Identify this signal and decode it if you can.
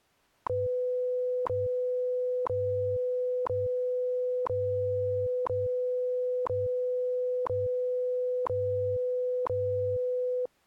Radio time signal (WWV, Colorado), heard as ticks, one a second.